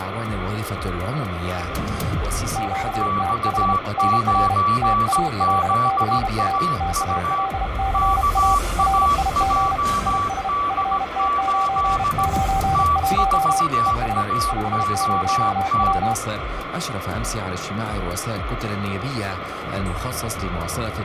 Morse code, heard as two keyed tones, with radio static. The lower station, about 32 wpm, 780 Hz: QTH NR TALCA TALCA RIG IS FT991 ES 50W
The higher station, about 17 wpm, 1150 Hz: X9ZAU KAJD8 T4AOT